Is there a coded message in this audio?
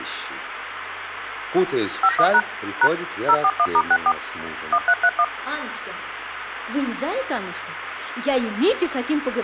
Yes: DTMF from 2.0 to 5.2 s, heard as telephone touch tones, dialled by machine, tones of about 60 ms, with phone line noise. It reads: 51# # 041*64 1331